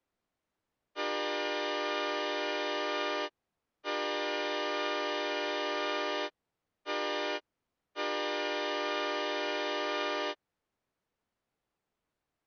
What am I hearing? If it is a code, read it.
Train horn signal, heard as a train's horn. 2 long, 1 short, 1 long. On North American railways: approaching a public crossing.